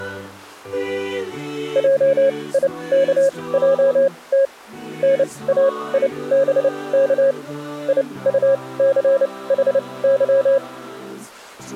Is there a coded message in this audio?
Yes: Morse code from 1.7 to 10.6 s, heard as a keyed tone, machine-sent, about 29 wpm, spaced as for 21 wpm, 540 Hz. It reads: JIKJT NAIBK IUCHY